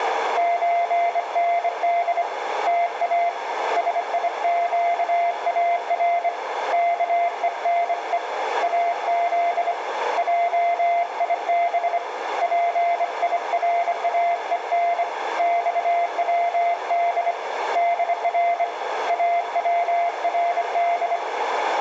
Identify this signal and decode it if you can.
Morse code (Persian alphabet), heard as a keyed tone, hand-sent with a bug key, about 25 wpm, 690 Hz, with radio static, a narrow filter and room echo. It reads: چند تا سیگار کهنه از جیب پیراهن خود در اورد